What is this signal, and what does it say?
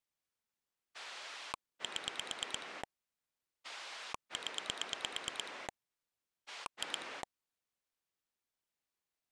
Pulse dialling, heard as a rotary dial, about 9 pulses a second. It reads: 7 0 2